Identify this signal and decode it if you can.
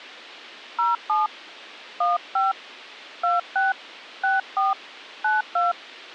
DTMF, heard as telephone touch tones, dialled by hand, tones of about 170 ms. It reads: 07 15 26 64 92